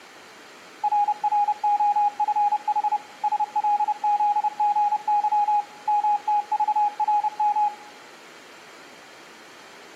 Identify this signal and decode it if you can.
Morse code, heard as a keyed tone, machine-sent, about 30 wpm, 820 Hz, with room echo. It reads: RROFH SLZGY MTVRM